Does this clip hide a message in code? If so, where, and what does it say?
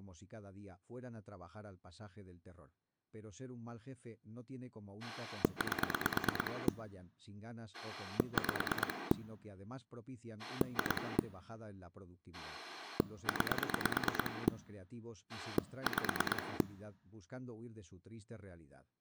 Yes: pulse dialling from 5.0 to 16.6 s, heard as a rotary dial, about 9 pulses a second, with speech in Spanish. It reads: 8 5 2 9 5